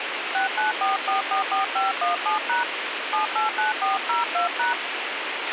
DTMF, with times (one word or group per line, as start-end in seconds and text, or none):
0.3-2.6 694444517#
3.1-4.7 789402#